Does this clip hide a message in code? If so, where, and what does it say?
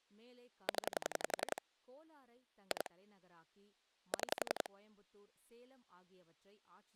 Yes: pulse dialling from 0.7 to 4.7 s, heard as clicks on a phone line, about 11 pulses a second, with speech in Tamil. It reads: 0 2 6